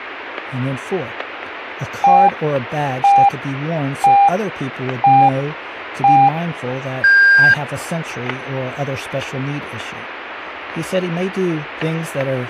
Radio time signal (five pips and a higher one, as on Chinese radio), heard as pips, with static crashes and speech in English.